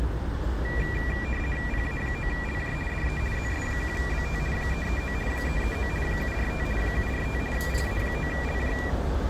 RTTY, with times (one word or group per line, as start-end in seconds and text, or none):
1.7-2.7 PA9LJ
2.9-3.2 DE
3.3-4.4 ZS1BT
4.5-5.1 339
5.3-5.9 339
6.0-6.6 745
6.8-7.4 745
7.5-8.7 PA9LJ